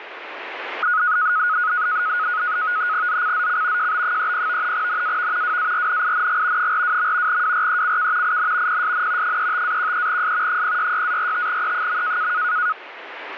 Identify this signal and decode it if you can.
NAVTEX (SITOR-B), 100 baud, 170 Hz shift, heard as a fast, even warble, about 1360 Hz centre, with radio static. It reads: ZCZC JB30 NAV WARNING 42. WRECK IN PSN 35-13S 066-45E.